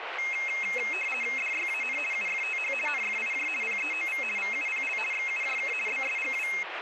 RTTY (50 baud, 450 Hz shift), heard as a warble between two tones, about 2350 Hz centre, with radio static and speech in Punjabi. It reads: DYAN UFTH NFIJ PEOV VUPL XUJK BSGW